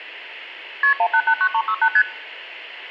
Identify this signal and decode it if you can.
Multi-frequency trunk signalling (R1, as on North American trunks), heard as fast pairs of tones, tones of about 70 ms, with room echo. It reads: KP 1889368 ST